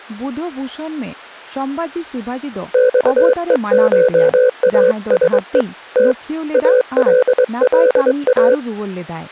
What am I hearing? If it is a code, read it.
Morse code (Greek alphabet), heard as a keyed tone, hand-sent with a straight key, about 23 wpm, 500 Hz, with speech in Santali. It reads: ΞΕΧΑΣΕ Τ ΑΛΛΑ